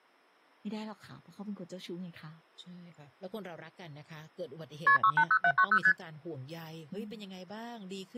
Multi-frequency trunk signalling (R1, as on North American trunks), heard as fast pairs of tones, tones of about 70 ms, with speech in Thai. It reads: KP 680790 ST